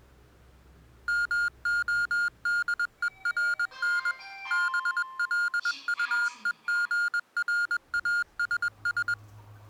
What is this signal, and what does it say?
Morse code, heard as electronic beeps, machine-sent, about 21 wpm, 1420 Hz, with the noise inside a lift. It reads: MODERN BLUEGRASS